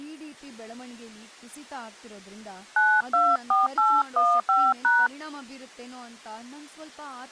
DTMF, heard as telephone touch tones, dialled by hand, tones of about 210 ms, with speech in Kannada. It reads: 924815#